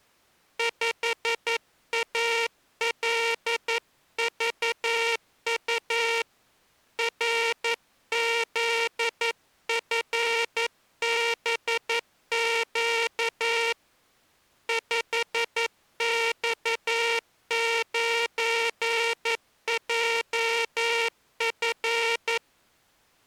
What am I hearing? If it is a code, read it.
Morse code, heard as a buzzer, hand-sent with a paddle, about 11 wpm. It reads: 5ALVU RZFBQ 5X9JF